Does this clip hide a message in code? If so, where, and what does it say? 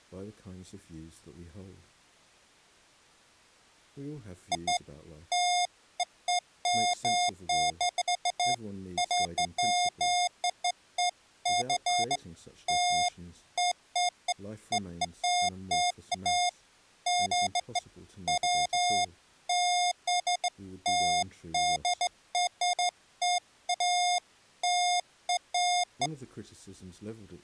No, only beeps of irregular length.